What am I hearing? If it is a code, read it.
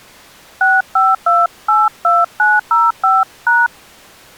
DTMF, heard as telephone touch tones, dialled by hand, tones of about 200 ms. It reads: 65282905#